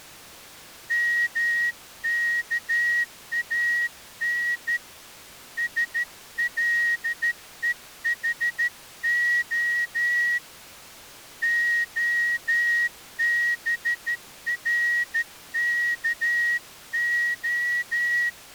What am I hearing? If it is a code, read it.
Morse code (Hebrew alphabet), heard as a whistle, hand-sent with a straight key, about 13 wpm. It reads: מכאן שלוחה הברכה